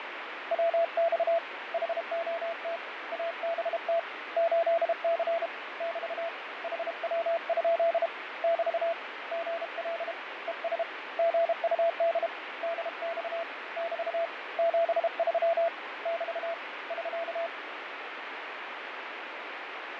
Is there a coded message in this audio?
Yes: Morse code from 0.5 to 17.5 s, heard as a keyed tone, hand-sent with a paddle, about 32 wpm, 670 Hz, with radio static and fading. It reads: WX HOT ABT 8C <BT> HW? <BT> GL ES GUD DX <BT> 73 <BT> <SK>